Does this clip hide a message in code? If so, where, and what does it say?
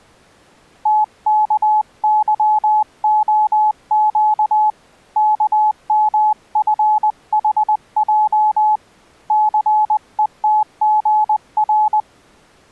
Yes: Morse code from 0.8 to 12.1 s, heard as a keyed tone, hand-sent with a paddle, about 20 wpm, 850 Hz. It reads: TKYOQ KMFHJ CETGR